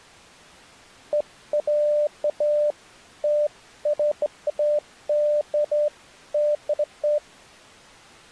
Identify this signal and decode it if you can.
Beeps of irregular length. There is no code.